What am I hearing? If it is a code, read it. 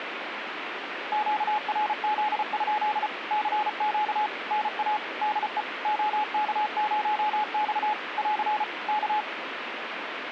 Morse code, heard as a keyed tone, machine-sent, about 34 wpm, 850 Hz, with radio static. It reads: QRZ? CQ NA DE OK0X <AR> K